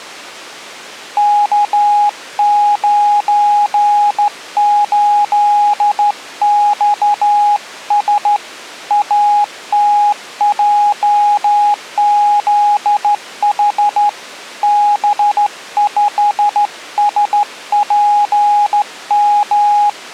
Morse code, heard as a keyed tone, hand-sent with a straight key, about 13 wpm, 830 Hz. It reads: K98XS ATJZH B5SPM